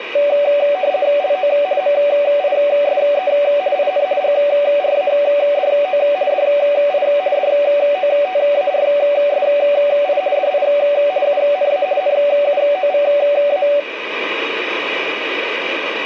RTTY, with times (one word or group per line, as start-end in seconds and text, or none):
1.2-1.5 LO
1.8-3.3 MISE
3.8-4.1 IN
4.2-6.0 GRADO
6.3-7.1 DI
7.4-10.2 DOTARSI
10.4-10.7 DI
11.3-11.9 UNA
12.0-13.7 NUOVA